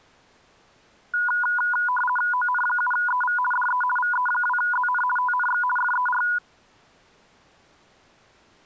RTTY (50 baud, 450 Hz shift), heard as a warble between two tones, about 1220 Hz centre. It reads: ON7EV DE VE2ZN TNX FER